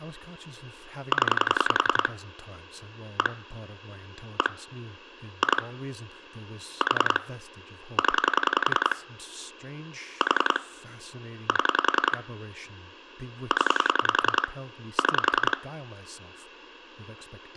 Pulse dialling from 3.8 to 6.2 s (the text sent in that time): 1 2